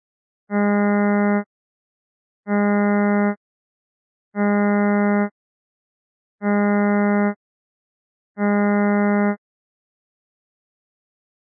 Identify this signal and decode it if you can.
Ship horn signal, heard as a ship's horn, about 200 Hz. 5 short. At sea: I doubt that you are doing enough to avoid a collision.